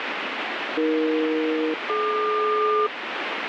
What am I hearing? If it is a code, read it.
Aircraft SELCAL, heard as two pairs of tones, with heavy radio static. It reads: AE-DQ